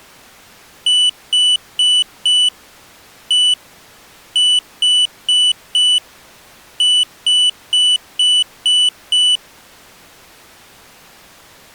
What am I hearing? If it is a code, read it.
Beep code, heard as a piezo beeper, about 2950 Hz. 4-1-4-6.